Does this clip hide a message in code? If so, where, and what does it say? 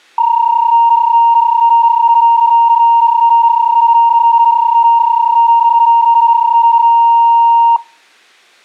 Yes: PSK31 (31.25 baud) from 0.2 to 7.8 s, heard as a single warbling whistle, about 930 Hz, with room echo.